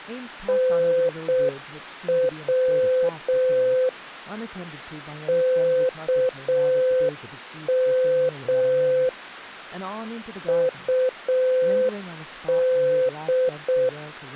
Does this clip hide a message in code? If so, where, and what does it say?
Yes: Morse code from 0.4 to 14.0 s, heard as a keyed tone, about 6 wpm, 510 Hz, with speech in English. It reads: NW KM UD